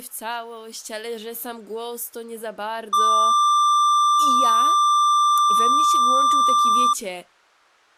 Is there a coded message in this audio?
No, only a steady tone, with speech in Polish.